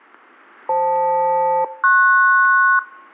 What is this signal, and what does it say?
Aircraft SELCAL, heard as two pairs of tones. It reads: FL-PS